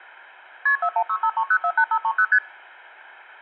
Multi-frequency trunk signalling (R1, as on North American trunks), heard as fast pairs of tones, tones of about 70 ms. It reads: KP 41653048530 ST